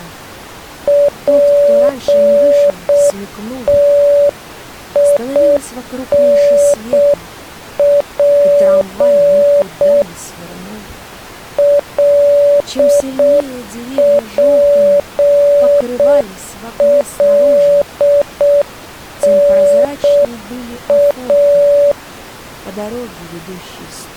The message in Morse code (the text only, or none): PTINP LPLNA